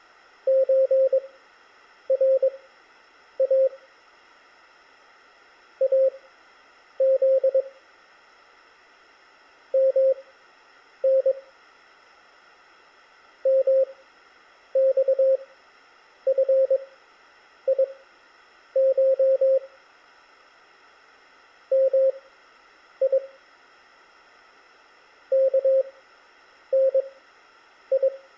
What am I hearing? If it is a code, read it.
Morse code (Persian alphabet), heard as a keyed tone, machine-sent, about 22 wpm, spaced as for 8 wpm, 530 Hz, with room echo. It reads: چرا از من مخفیش می کنی